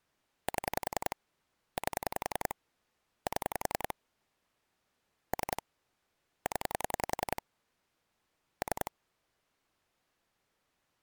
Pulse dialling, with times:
0.5-1.2 7
1.8-2.5 8
3.3-3.9 7
5.3-5.6 3
6.5-7.4 0
8.6-8.9 3

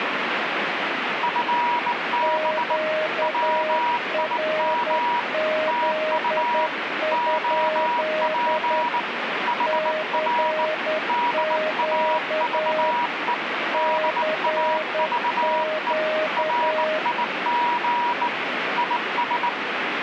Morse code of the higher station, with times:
1.2-2.8 FB
3.2-5.2 WIM
5.7-6.7 TU
7.1-9.0 OP
9.5-10.7 HR
11.1-13.3 DAVE
13.7-15.9 DAVE
16.4-18.3 RIG
18.8-19.5 IS

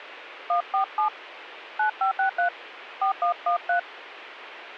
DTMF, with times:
0.5-1.1 147
1.8-2.5 9563
3.0-3.8 4113

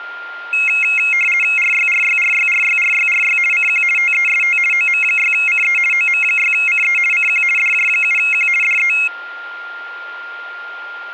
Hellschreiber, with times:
none

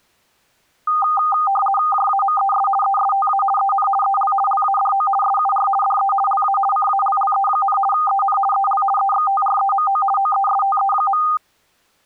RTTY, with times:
1.9-2.7 JAMES
2.8-3.4 ESTA
3.6-3.9 EN
4.0-4.3 EL
4.5-5.1 LADO
5.2-5.7 SUR
5.8-6.1 DE
6.3-6.6 LA
6.7-7.8 CALLE,
7.9-8.4 EN
8.5-8.8 EL
9.0-10.0 EXTREMO
10.2-11.2 OESTE.

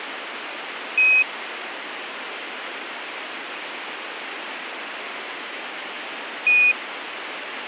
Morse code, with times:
none

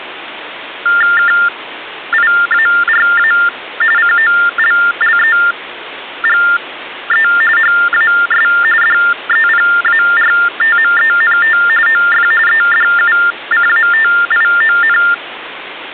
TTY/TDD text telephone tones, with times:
1.2-3.3 KIARA
4.0-7.3 COLLEGE
7.6-8.5 HAS
8.8-11.6 DEPARTMENT
11.9-12.3 OF
12.5-15.0 EDUCATION

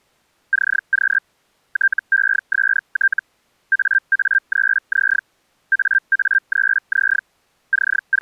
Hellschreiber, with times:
0.5-1.2 CQ
1.7-3.2 TEST
3.7-5.2 AA3Z
5.7-7.2 AA3Z
7.7-8.2 …

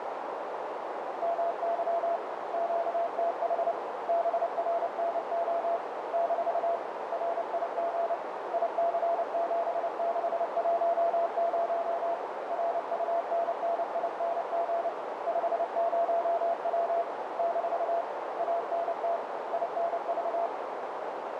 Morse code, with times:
1.2-2.2 MY
2.5-3.7 QTH
4.1-5.8 BRNO
6.1-6.8 -
7.1-8.1 RIG
8.5-12.1 IC7610
12.5-14.9 RUNNING
15.3-17.0 50W
17.4-18.0 -
18.4-19.2 ANT
19.5-20.5 INV

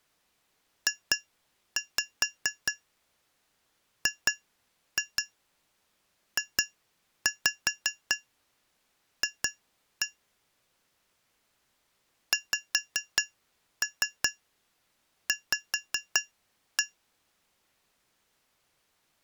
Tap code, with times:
0.9-10.1 JGJF
12.3-16.8 XV

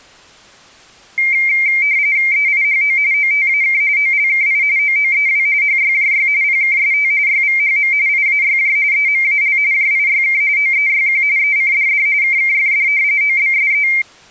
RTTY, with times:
2.3-3.0 EIHO
3.1-3.8 OTAK
4.0-4.6 OLKI
4.8-5.5 OOEW
5.6-6.3 HYJY
6.4-7.1 PKST
7.3-7.9 YVHM
8.1-8.8 IAYJ
8.9-9.6 EMAL
9.7-10.4 JIYK
10.6-11.2 OEYQ
11.4-12.1 ECDD
12.2-12.9 KKFD
13.2-13.9 OBSE

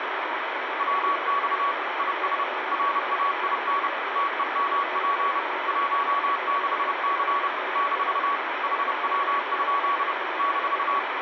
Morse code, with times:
0.8-1.7 WX
2.0-2.4 IS
2.7-3.9 RAIN
4.2-5.4 TEMP
5.7-7.5 16C
7.8-8.4 -
8.6-10.1 HW?
10.4-11.0 -

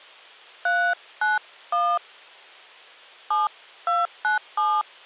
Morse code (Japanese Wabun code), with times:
none

